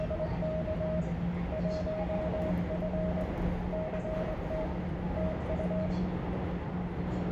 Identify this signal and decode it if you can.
Morse code, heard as a keyed tone, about 22 wpm, 630 Hz, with room echo and the noise inside a subway train. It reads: … 1F CT TU